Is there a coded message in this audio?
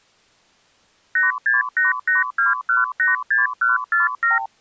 Yes: multi-frequency trunk signalling (R2, with the far end's replies) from 1.2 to 4.5 s, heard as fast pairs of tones, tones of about 150 ms. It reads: 86882186147